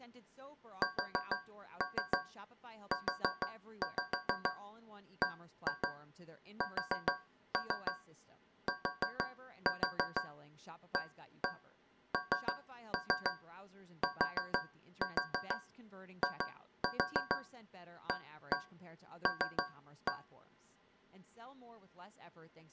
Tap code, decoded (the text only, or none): SUBSTANTIAL